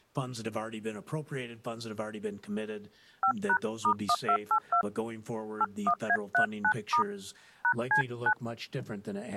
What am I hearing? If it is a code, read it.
DTMF, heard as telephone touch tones, dialled by hand, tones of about 70 ms. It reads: 5#*1282 81A39* #C9